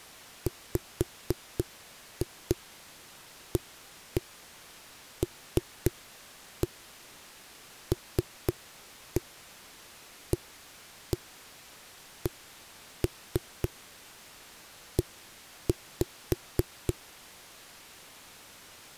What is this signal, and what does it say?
Tap code, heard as knocks on a wall, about 3 knocks a second. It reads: WALLACE